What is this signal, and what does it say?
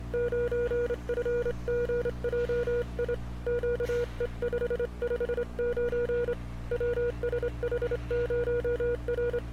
Morse code, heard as a keyed tone, hand-sent with a straight key, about 27 wpm, 480 Hz, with street noise. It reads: 9FGJI QE559 WSH0R